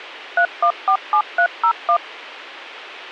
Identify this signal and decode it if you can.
DTMF, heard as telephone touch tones, dialled by machine, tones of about 80 ms. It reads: 3147301